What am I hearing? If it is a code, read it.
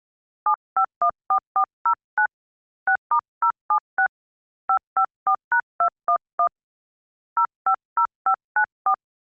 DTMF, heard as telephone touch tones, dialled by hand, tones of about 80 ms. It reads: 7514409 6*076 554#211 050594